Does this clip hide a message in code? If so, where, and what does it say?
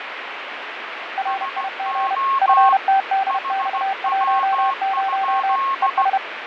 Yes: Morse code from 1.1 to 6.2 s, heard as two keyed tones, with radio static and fading. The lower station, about 31 wpm, 780 Hz: RIG FTDX10 ES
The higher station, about 16 wpm, 1080 Hz: SO HW?